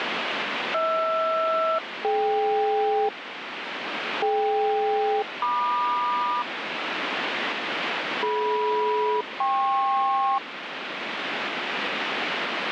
Aircraft SELCAL, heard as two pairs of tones, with radio static. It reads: HR-DK DK-MQ DM-KP